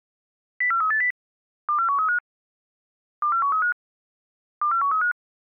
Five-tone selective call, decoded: 04380 24135 24135 24135

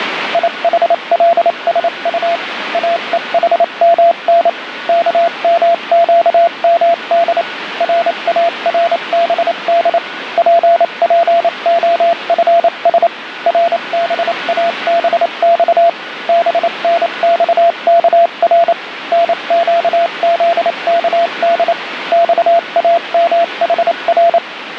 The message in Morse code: IHLSU AEHMN KMQMD RARBD PPOFS RBABX BNXKR NQZKD XAMHR

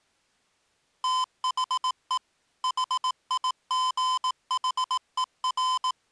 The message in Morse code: THE HIGHER

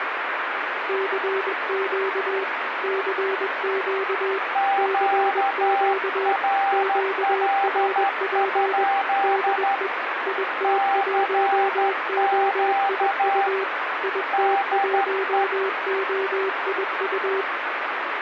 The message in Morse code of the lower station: CQ CQ CQ QRP DE IT1OIU IT1OIU

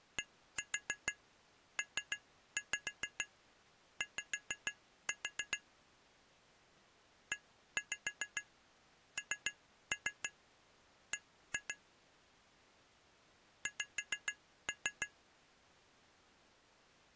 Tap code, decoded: DPY ENB X

